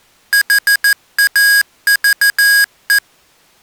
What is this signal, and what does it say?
Morse code, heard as electronic beeps, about 14 wpm, 1650 Hz. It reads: HAVE